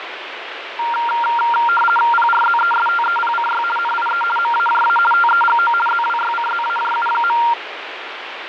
RTTY (50 baud, 450 Hz shift), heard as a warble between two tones, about 1160 Hz centre, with radio static. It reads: PRZESTEPCY NIE MAJA TEGO ZWYCZAJU.